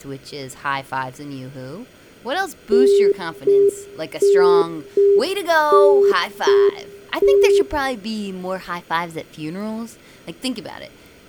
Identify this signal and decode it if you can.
Telephone call progress tone (UK plan), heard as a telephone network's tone, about 400 Hz, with room echo. Congestion tone.